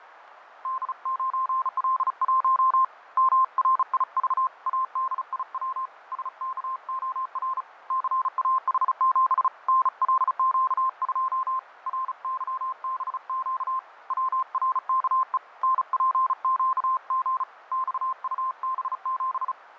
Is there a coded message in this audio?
Yes: Morse code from 0.6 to 19.6 s, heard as a keyed tone, hand-sent with a bug key, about 35 wpm, 1050 Hz, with radio static and fading. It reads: D9L1 MRIV ADIW SKOR CAH7 NLQ2 RYBQ WRKE NPQG XUB7